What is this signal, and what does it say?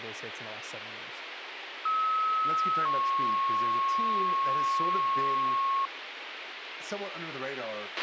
Two-tone page, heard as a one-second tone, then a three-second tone, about 1290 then 1090 Hz, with radio hiss, a squelch burst at the end and speech in English.